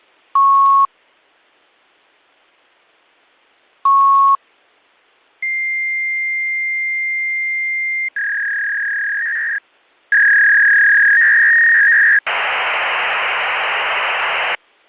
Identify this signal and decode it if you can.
Fax machine handshake, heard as beeps, a long tone, a warble and hiss.